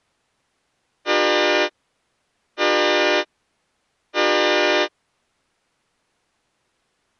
Train horn signal, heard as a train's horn. 3 short. On North American railways: when stopped, the train will back up.